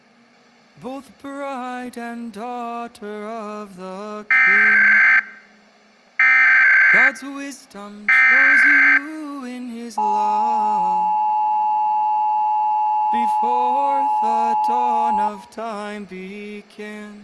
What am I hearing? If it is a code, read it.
Emergency Alert System (SAME) tones (header bursts, then the 853 and 960 Hz attention tone), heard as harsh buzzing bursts, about 520.83 baud.